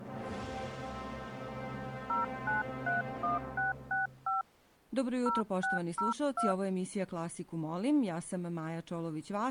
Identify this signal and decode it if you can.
DTMF, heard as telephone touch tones, dialled by hand, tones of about 150 ms. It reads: 0931665 0602